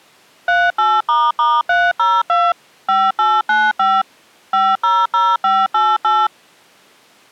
DTMF, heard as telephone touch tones, dialled by machine, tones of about 220 ms. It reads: 38**302 5895 500588